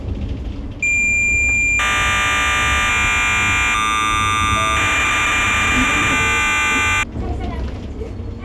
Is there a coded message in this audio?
Yes: cassette data (Kansas City type), 1200 baud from 0.8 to 7.0 s, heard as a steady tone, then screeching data, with the noise inside a bus.